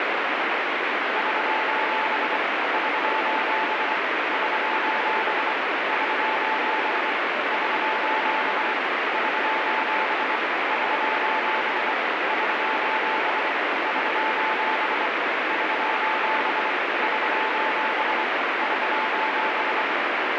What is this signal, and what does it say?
Morse code, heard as a keyed tone, hand-sent with a paddle, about 24 wpm, 880 Hz, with heavy radio static. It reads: <SOS> <SOS> <SOS> <SOS> <SOS> <SOS> <SOS> <SOS> <SOS> <SOS> <SOS> <SOS>